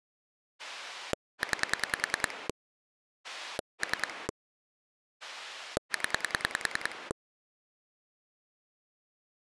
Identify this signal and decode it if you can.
Pulse dialling, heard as a rotary dial, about 10 pulses a second. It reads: 9 3 0